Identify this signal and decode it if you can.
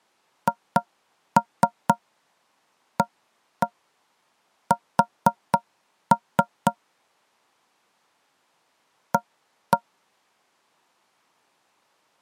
Tap code, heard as knocks on wood, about 4 knocks a second. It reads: HAS A